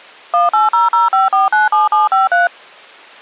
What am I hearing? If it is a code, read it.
DTMF, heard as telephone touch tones, dialled by machine, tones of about 160 ms. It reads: 18005497753